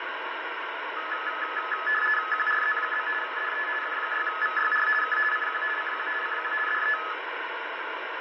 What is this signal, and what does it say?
RTTY (50 baud, 450 Hz shift), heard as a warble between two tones, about 1500 Hz centre, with radio static. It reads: QRZ? DE F6VYR K CQ CQ CQ DE